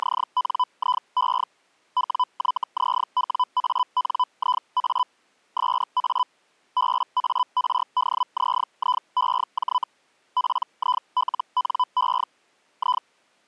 Hellschreiber (Feld-Hell, 122.5 baud), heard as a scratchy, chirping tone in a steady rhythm, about 1000 Hz. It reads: … WYZWANIA SA BARDZIEJ PILNE I